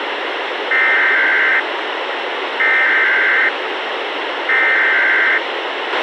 Emergency Alert System (SAME) tones (header bursts), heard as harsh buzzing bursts, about 520.83 baud, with radio hiss and a squelch burst at the end.